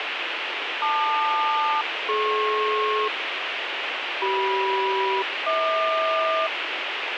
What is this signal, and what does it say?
Aircraft SELCAL, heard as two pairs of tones, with radio hiss. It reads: LQ-DP CM-HQ